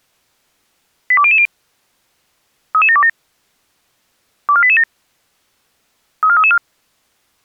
Five-tone selective call (ZVEI), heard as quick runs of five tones, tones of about 70 ms. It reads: 82000 33727 24887 34334